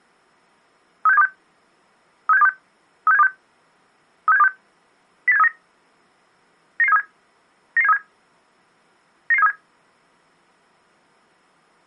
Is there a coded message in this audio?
Yes: five-tone selective call (EEA) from 1.1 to 9.5 s, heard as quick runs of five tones, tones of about 40 ms. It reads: 36726 36726 36726 36726 08739 99737 99737 99737